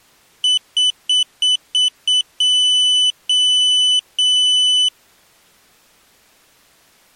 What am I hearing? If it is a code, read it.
Beep code, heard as a piezo beeper, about 3000 Hz. 6 short, 3 long.